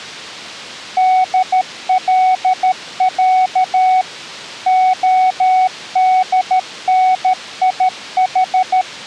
Morse code (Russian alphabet), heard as a keyed tone, machine-sent, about 13 wpm, 750 Hz. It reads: ДЛЯ ОДНИХ